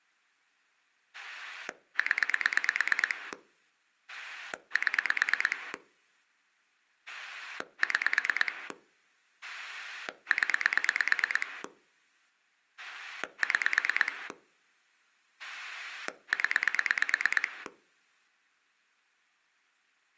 Pulse dialling, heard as a rotary dial, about 9 pulses a second. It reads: 0 7 6 0 6 0